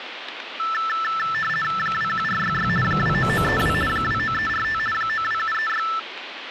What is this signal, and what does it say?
RTTY (50 baud, 450 Hz shift), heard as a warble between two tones, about 1550 Hz centre, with radio static. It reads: 21466 29932 29345 92736